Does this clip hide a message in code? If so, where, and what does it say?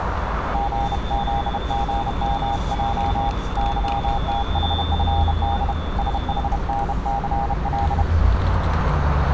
Yes: Morse code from 0.5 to 8.1 s, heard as a keyed tone, hand-sent with a bug key, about 31 wpm, 800 Hz, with radio static, a narrow filter and street noise. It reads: GZGMJ YTHFD SHNCL